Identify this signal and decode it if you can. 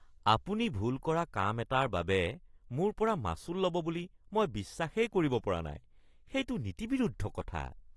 Speech in Assamese. There is no code.